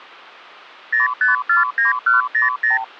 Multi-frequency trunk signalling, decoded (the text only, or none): 0549100